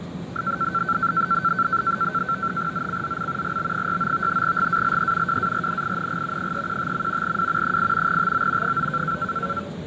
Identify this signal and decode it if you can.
NAVTEX (SITOR-B), 100 baud, 170 Hz shift, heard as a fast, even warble, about 1440 Hz centre, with fading and the noise inside a subway train. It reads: ZCZC GB69 GALE WARNING 315. W 8 TO 9